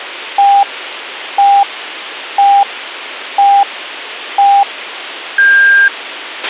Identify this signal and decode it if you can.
Radio time signal (five pips and a higher one, as on Chinese radio), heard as pips, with radio hiss and a squelch burst at the end.